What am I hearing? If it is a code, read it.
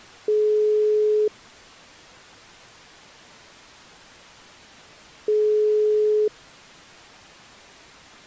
Telephone call progress tone (single-tone plan, as in most of Europe), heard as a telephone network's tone, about 420 Hz, 1 s on and 4 s off. Ringback tone.